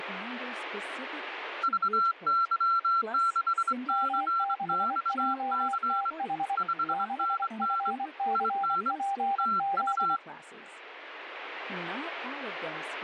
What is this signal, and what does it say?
Morse code, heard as two keyed tones, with speech in English. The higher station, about 23 wpm, 1360 Hz: VY6CXC 5NN IN TU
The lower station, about 24 wpm, 790 Hz: M6JTH 6FCPZ